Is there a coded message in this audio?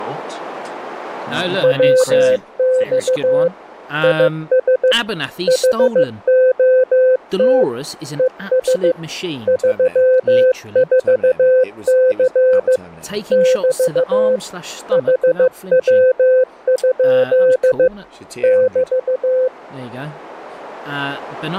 Yes: Morse code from 1.6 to 19.5 s, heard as a keyed tone, machine-sent, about 15 wpm, 510 Hz, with speech in English. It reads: WX IS HOT ES 34C <BT> HW? <BT>